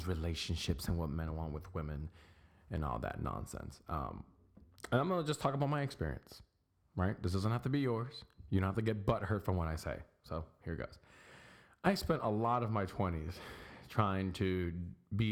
Speech in English. There is no code.